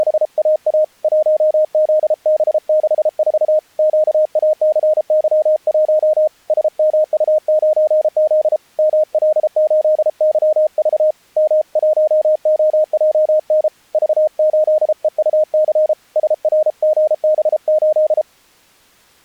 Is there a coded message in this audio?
Yes: Morse code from 0.0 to 18.3 s, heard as a keyed tone, hand-sent with a paddle, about 33 wpm, 620 Hz. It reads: … 1ZB64 QACY1 SMU9Z ML8YV M1OJN V8EUC SRGB8